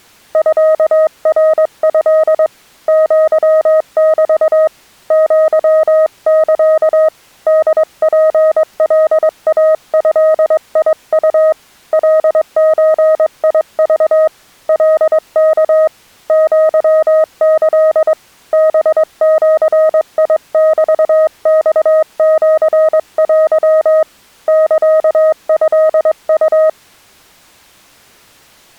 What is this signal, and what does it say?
Morse code (Japanese Wabun code), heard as a keyed tone, hand-sent with a straight key, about 22 wpm, 630 Hz. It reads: ミナト アメ アサ ホツカイドウ カゾク カワ アキ ハジメマシテ サトウ